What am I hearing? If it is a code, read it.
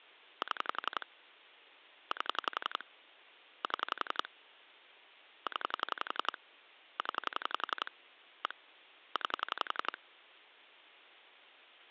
Pulse dialling, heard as clicks on a phone line, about 11 pulses a second. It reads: 7 8 7 0 0 1 9